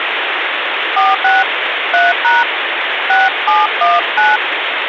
DTMF, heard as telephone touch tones, dialled by hand, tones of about 190 ms, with phone line noise. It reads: 46 3# 6719